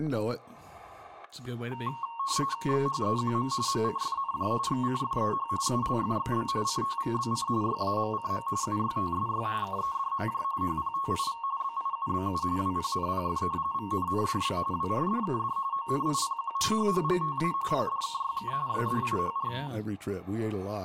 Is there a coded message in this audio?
Yes: RTTY (45.45 baud, 170 Hz shift) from 1.7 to 19.7 s, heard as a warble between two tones, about 1010 Hz centre, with static crashes, room echo and speech in English. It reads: XHEQM MCFNJ XCFEH ULFXB CTVBC YAMCM UYTSY KEDMJ HPTIV BIUBU WPNPF VNNDB WRDKD ONIPQ HHGTA PDKYK YDIHR